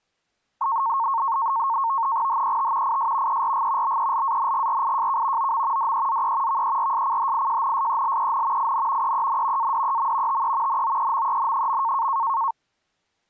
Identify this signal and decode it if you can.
NAVTEX (SITOR-B), 100 baud, 170 Hz shift, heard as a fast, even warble, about 1000 Hz centre. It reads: HET IS ERG BELANGRIJK OM DEZE VERSCHIJNSELEN IN EEN ADEM TE NOEMEN.